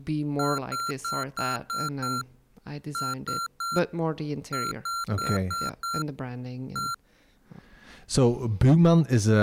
Beep code, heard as beeps from a small speaker, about 1370 Hz, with speech in English. 6-3-5-1.